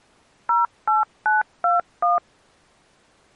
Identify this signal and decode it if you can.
DTMF, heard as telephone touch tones, dialled by machine, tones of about 160 ms. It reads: 08921